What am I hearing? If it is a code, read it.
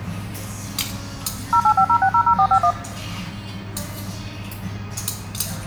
DTMF, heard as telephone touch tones, dialled by machine, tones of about 80 ms, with the noise of a restaurant. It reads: 0850600451